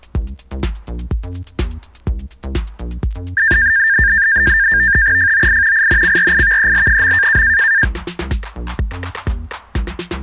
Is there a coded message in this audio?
Yes: NAVTEX (SITOR-B), 100 baud, 170 Hz shift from 3.4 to 7.8 s, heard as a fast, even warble, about 1700 Hz centre. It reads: FOI INCRIVEL.